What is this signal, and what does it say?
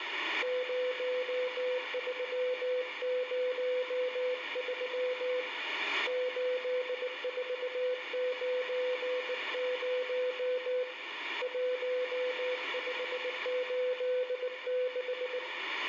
Morse code, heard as a keyed tone, hand-sent with a bug key, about 19 wpm, 500 Hz, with radio static and room echo. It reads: 0303 8490 1586